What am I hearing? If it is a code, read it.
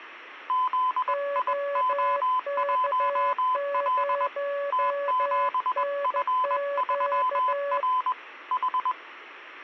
Morse code, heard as two keyed tones. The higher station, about 21 wpm, 1010 Hz: ZIO1L T7F3R H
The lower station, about 14 wpm, 570 Hz: OK0NQ